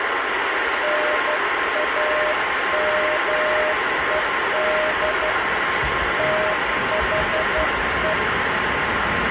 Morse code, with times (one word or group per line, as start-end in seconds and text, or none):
0.8-5.3 NAMED
6.2-8.1 THE